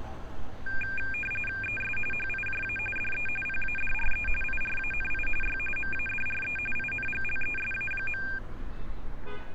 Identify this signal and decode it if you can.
RTTY (45.45 baud, 850 Hz shift), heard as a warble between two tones, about 2000 Hz centre, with street noise. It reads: ES HIJA DE PADRE IRANI Y MADRE INGLESA.